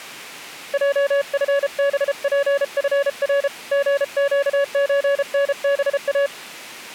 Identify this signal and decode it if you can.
Morse code (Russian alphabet), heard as a keyed tone, hand-sent with a paddle, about 33 wpm, 560 Hz. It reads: ЙФБПФР ГЩЧНБА